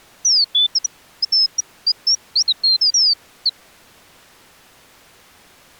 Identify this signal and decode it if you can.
Bird-like chirps. There is no code.